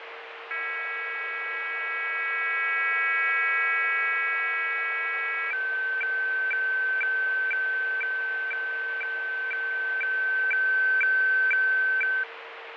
Weather fax (radiofax), 120 lines a minute, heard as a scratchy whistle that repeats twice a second, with radio static, fading and a steady whistle near 460 Hz.